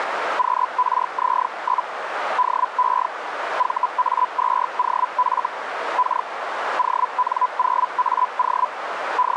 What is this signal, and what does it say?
Hellschreiber (Feld-Hell, 122.5 baud), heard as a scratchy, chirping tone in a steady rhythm, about 1000 Hz, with radio static and a narrow filter. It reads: QRZ? DE VA2OF K ON0AO …